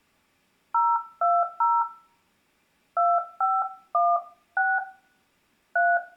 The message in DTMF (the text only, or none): 020 2516 3